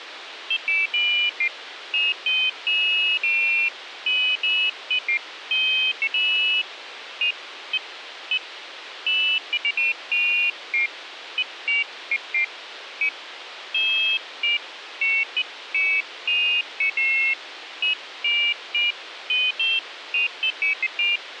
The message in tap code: none

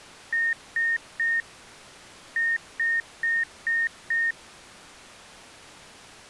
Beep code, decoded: 3-5

